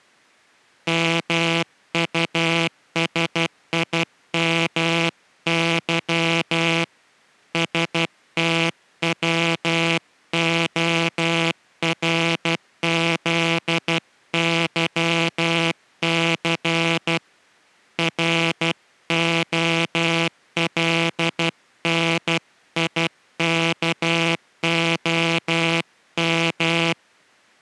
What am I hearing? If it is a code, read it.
Morse code, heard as a buzzer, hand-sent with a paddle, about 12 wpm. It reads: MUSIMY STWORZYC ROLNIKOM